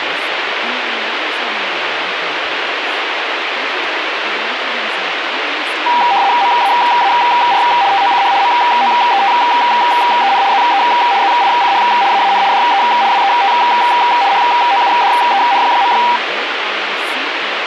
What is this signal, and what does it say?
RTTY (75 baud, 170 Hz shift), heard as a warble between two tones, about 880 Hz centre, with radio static and speech in English. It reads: MAAR TOCH MOETEN ZE ZICH AAN DE WET HOUDEN.